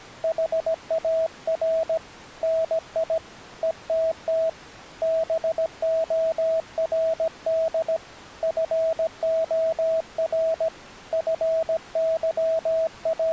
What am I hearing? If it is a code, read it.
Morse code, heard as a keyed tone, hand-sent with a paddle, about 17 wpm, 650 Hz. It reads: HAR NI ETT BORD FOR …